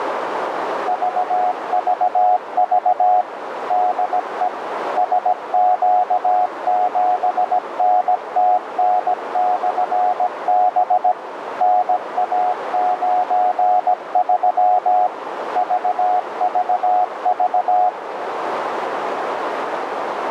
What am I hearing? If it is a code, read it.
Morse code, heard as a keyed tone, machine-sent, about 17 wpm, 730 Hz, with radio static and a narrow filter. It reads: VVV DE SQ7NTN/B NA93 VVV